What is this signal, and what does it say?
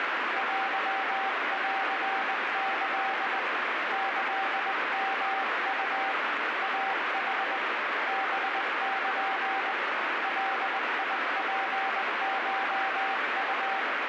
Morse code (Japanese Wabun code), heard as a keyed tone, hand-sent with a straight key, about 20 wpm, 780 Hz, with heavy radio static. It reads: テンキ キヨウ イヌ ハル ガツコウ